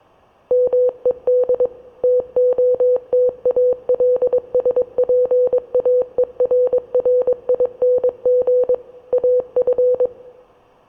Morse code, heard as a keyed tone, machine-sent, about 22 wpm, 500 Hz. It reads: MED TOTALSPAERRING AF